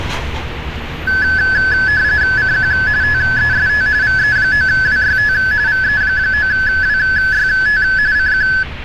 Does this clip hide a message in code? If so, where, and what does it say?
Yes: RTTY (45.45 baud, 170 Hz shift) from 1.1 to 8.6 s, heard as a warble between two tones, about 1600 Hz centre, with street noise. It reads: CQ TEST VE9WYT VE9WYT CQ